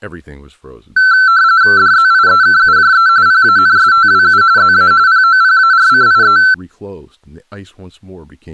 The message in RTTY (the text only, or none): DZIEKUJE PANSTWU ZA POPARCIE